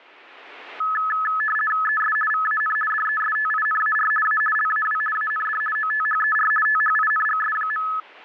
RTTY (50 baud, 450 Hz shift), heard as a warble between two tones, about 1500 Hz centre. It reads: ES VAN DESTINAR A LAW AND OTHER THINGS.